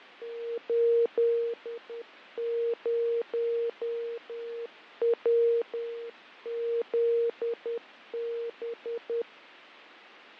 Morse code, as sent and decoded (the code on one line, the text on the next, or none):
---.. ----- .-- --.. -...
80WZB